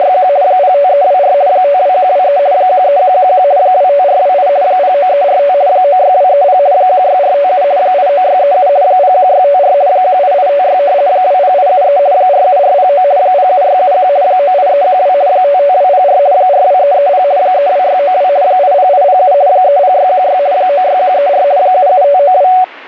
RTTY (50 baud, 170 Hz shift), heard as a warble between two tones, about 660 Hz centre. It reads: … 05324 52123 13111 25428 09345 96230 16457 89637 01654 18856 20873 47409 07671 98312 55204 42330 32692 80807 30616 96134 77592